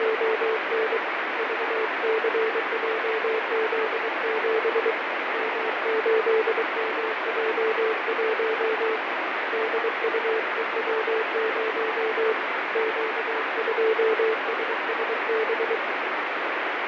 Morse code, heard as a keyed tone, hand-sent with a paddle, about 23 wpm, 440 Hz, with heavy radio static and fading. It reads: … VCJZ7 M8MJ1 DUEW0 Q2SSB